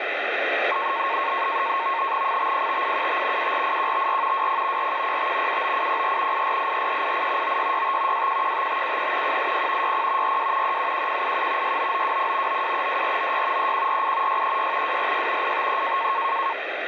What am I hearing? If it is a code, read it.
NAVTEX (SITOR-B), 100 baud, 170 Hz shift, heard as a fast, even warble, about 1000 Hz centre, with radio static. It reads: 505875 748154 20 4105 79804 8484388 9665 2115573 180 60 42 371187 69920 9232496 3148 636 246 853